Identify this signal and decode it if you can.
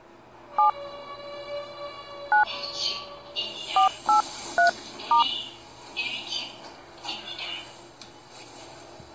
DTMF, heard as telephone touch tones, dialled by hand, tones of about 120 ms, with the noise inside a lift. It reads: 7 9 483*